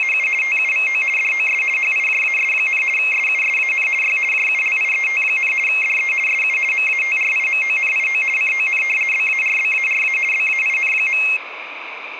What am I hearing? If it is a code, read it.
RTTY (50 baud, 450 Hz shift), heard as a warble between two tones, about 2350 Hz centre, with radio static. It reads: … TUVO DOS HIJAS, SUSAN Y JULIET, DE SU MATRIMONIO CON BARBARA BAIN.